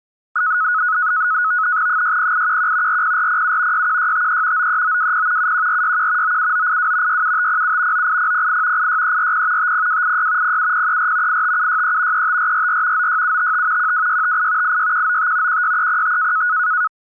NAVTEX (SITOR-B), 100 baud, 170 Hz shift, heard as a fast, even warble, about 1370 Hz centre. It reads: 60811 40407 61653 93920 71461 97982 67507 98008 86340 50286 07034 85763 35444 96755 12658 86195 16305